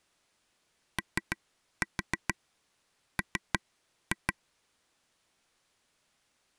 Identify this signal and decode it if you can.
Tap code, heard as taps on a table, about 6 knocks a second. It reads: OM